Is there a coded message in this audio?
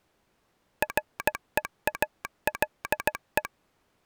Yes: Morse code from 0.8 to 3.5 s, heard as a telegraph sounder, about 16 wpm. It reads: REALE